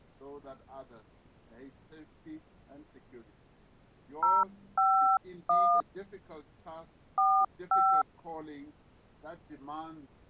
DTMF, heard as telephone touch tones, dialled by hand, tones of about 300 ms. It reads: 051 45